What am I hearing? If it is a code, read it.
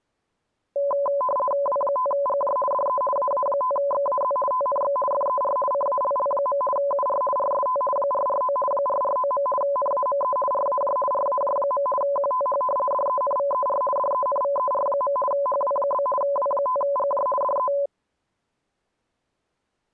RTTY (50 baud, 450 Hz shift), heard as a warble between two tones, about 790 Hz centre. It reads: W5GJ DE AA5XAZ TNX FER CALL. UR RST 449 449. NAME RAJ RAJ. QTH DENVER DENVER. HW? W5GJ DE